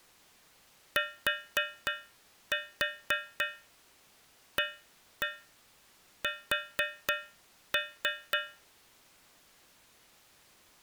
Tap code, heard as taps on a metal pipe, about 3 knocks a second. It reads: TAS